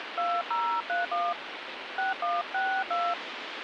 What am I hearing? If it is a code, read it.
DTMF, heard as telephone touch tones, dialled by hand, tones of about 250 ms, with phone line noise. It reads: 2031 6162